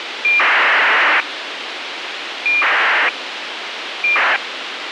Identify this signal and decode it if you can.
ACARS aircraft data, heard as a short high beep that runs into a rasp, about 2400 baud, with radio hiss.